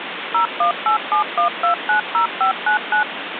DTMF, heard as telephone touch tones, dialled by machine, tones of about 110 ms, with phone line noise. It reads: 01871290599